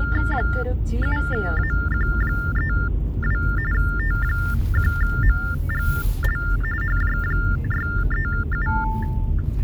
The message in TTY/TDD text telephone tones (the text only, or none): 7AQ32 T1MGL HJ637